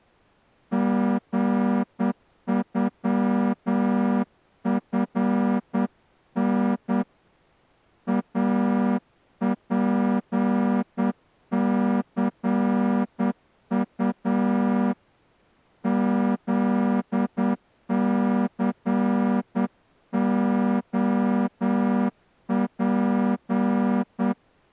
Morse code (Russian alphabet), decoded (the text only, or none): ГЮФН АПЦУ ЗЦОП